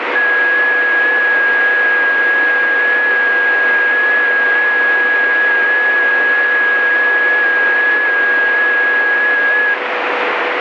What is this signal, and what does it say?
FT8 (one signal), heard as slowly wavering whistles, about 6.25 baud, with radio static.